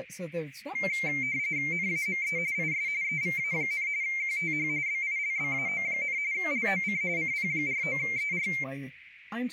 RTTY (45.45 baud, 170 Hz shift), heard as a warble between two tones, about 2200 Hz centre, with radio static and speech in English. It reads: NAME IS EVA, QTH BILBAO, LOC CP49ER